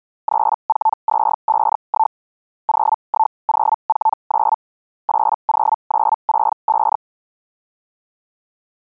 Hellschreiber (Feld-Hell, 122.5 baud), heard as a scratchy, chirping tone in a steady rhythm, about 880 Hz. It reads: 34251 01049 80965